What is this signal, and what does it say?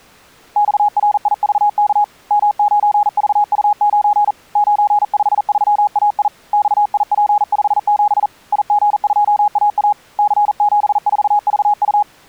Morse code, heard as a keyed tone, hand-sent with a paddle, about 40 wpm, 830 Hz. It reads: XRIVK M9VU9 953AI XIP57 IG2AA C74VU